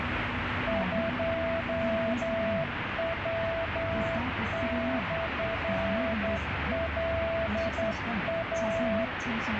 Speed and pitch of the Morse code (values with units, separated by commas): 10 wpm, 660 Hz